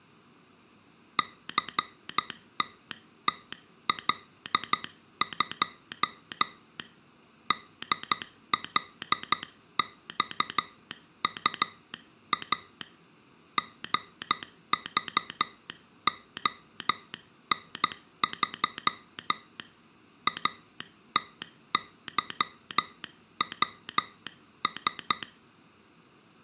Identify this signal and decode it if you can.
Morse code, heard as a telegraph sounder, hand-sent with a straight key, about 12 wpm. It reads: CTTL2 DLXUA GVON3 ATYWS